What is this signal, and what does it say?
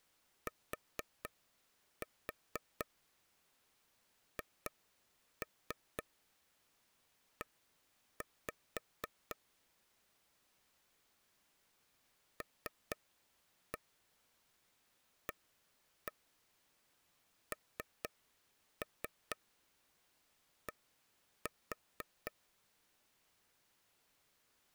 Tap code, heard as taps on a table, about 4 knocks a second. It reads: THE LAND